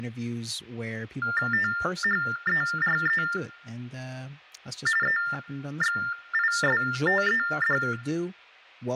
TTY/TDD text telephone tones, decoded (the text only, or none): THERE EXISTED